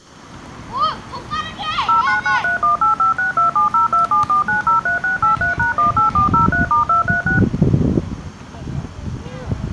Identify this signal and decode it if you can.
DTMF, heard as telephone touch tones, dialled by machine, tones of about 130 ms, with the noise of a residential street. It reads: 09931856270274903683#18403*236